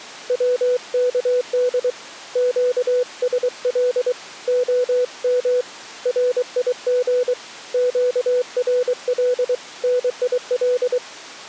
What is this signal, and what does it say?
Morse code, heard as a keyed tone, hand-sent with a paddle, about 23 wpm, 500 Hz. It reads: WKD QSL OM RIG QRL NIL